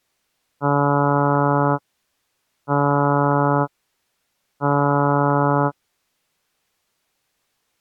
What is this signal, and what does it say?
Ship horn signal, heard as a ship's horn, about 140 Hz. 3 short. At sea: I am operating astern propulsion.